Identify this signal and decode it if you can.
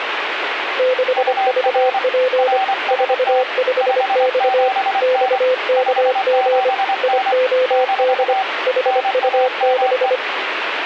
Morse code, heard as two keyed tones, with radio static. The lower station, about 25 wpm, 510 Hz: 6VP 45X XKG IOD HU6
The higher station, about 24 wpm, 770 Hz: UR RST 57N 57N - NAME